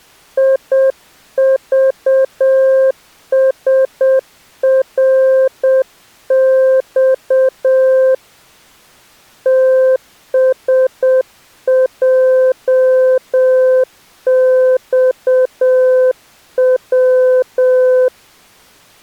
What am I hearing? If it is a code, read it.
Morse code, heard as a keyed tone, hand-sent with a paddle, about 7 wpm, 520 Hz. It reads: IVSRX TSJXW